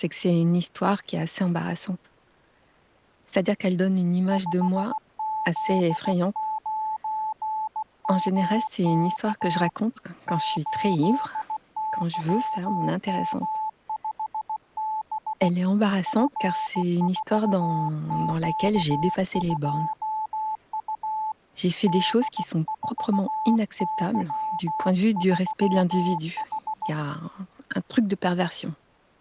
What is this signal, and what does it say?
Morse code, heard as a keyed tone, hand-sent with a bug key, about 16 wpm, 870 Hz. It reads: 5Z9MK 8YM5B F4Q2U D4Y3H